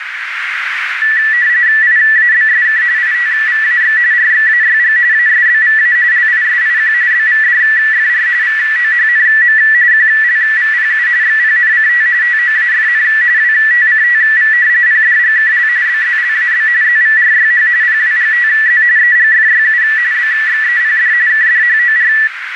RTTY (45.45 baud, 170 Hz shift), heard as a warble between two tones, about 1850 Hz centre, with radio static and a narrow filter. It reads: IABSK ITVAX RXAYG ASBVA LISIQ BVDFR VOHNM QLVPU XPNCT TOAFN WTCTV PDGKL BZLAB ZVRYH PWGTZ EGFYU BXEPD KDHOR